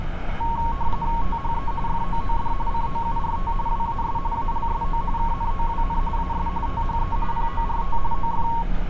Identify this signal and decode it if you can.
RTTY (45.45 baud, 170 Hz shift), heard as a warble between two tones, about 1010 Hz centre, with radio static and street noise. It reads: THE FOOD COURT WAS ALSO KNOWN AS THE PORT OF